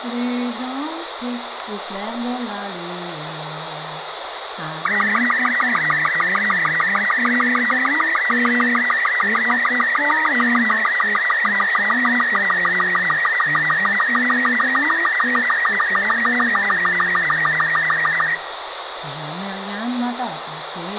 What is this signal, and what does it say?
SSTV (slow-scan television), Robot 36, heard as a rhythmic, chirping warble, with radio hiss and a squelch burst at the end.